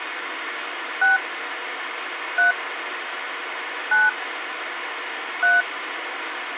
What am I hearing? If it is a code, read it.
DTMF, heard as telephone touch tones, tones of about 170 ms, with phone line noise. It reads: 6 3 9 3